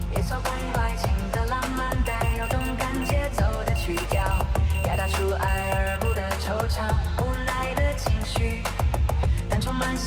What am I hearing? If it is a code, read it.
Morse code, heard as a high beeper, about 13 wpm, 2750 Hz, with room echo. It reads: HE HAD